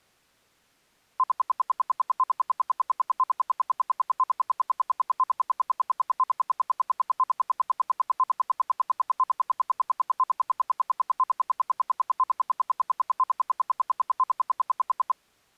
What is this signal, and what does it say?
Radio time signal (RWM, Moscow), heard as ten pulses a second.